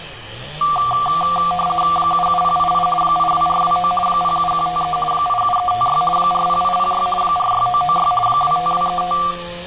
RTTY (50 baud, 450 Hz shift), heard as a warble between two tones, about 940 Hz centre, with room echo and street noise. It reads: 77088 82429 07153 87356 40806 46996 25235